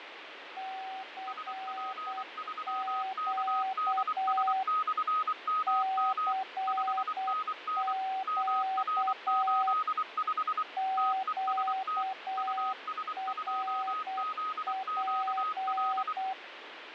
Morse code, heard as two keyed tones, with radio static and fading. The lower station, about 8 wpm, 760 Hz: CQ CQ QRP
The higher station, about 24 wpm, 1260 Hz: SP3KDS/MM 5NN MR85 TEST US2ZQL